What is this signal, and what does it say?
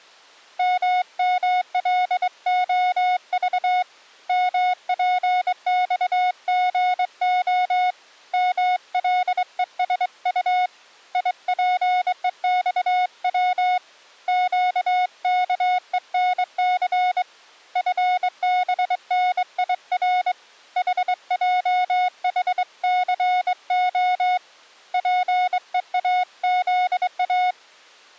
Morse code, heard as a keyed tone, hand-sent with a straight key, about 23 wpm, 730 Hz. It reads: MMLOV MPXGO MLESU IPEXW QKENC FBNIR HJHCO PEAZA